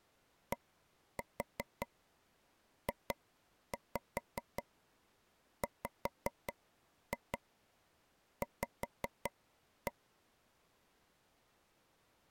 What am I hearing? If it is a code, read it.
Tap code, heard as taps on a table, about 5 knocks a second. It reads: DJWV